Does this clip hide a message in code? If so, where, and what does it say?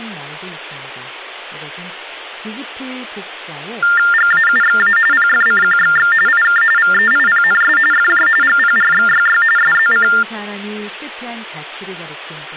Yes: TTY/TDD text telephone tones (45.45 baud Baudot) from 3.8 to 10.2 s, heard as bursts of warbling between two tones, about 400 Hz shift, 1600 Hz centre, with speech in Korean. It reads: GAUXA PFCQXX IK VEIPNS FJ GPRXYY SZC